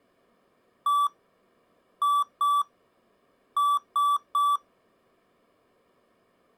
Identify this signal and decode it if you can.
Beep code, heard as beeps from a small speaker, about 1160 Hz. 1-2-3. In Phoenix BIOS tables: DMA page register failure.